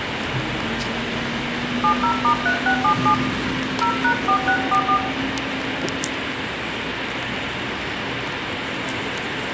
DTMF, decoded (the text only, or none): 70*3677 0#4644